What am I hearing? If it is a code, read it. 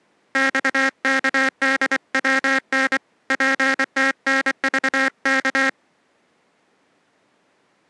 Morse code, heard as a buzzer, hand-sent with a paddle, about 24 wpm. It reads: XKDWN PTNVK